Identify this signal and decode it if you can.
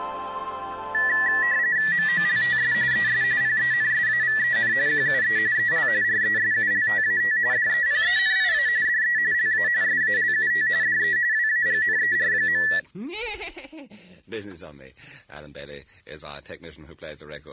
RTTY (45.45 baud, 170 Hz shift), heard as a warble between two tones, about 1850 Hz centre. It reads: MOLTS ES PENSAVEN QUE EL RESULTAT DEPENIA DE LA SALUT DE WAGNER.